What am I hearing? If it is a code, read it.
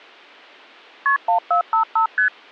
Multi-frequency trunk signalling (R1, as on North American trunks), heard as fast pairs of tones, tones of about 110 ms. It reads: KP 1455 ST